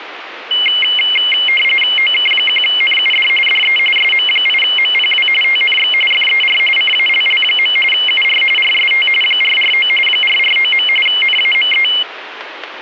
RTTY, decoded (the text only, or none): OK1NUD DE SM8MPW TNX FER CALL. UR RST 449 449. NAME